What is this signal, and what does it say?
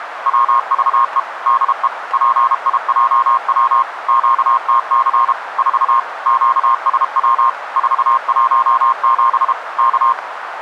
Morse code, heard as a keyed tone, machine-sent, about 32 wpm, 1070 Hz, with radio static and a narrow filter. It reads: WVE DE PIJW QTC 4 QSW 417 K